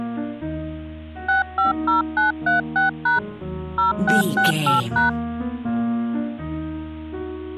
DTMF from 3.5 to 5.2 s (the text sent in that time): 0668#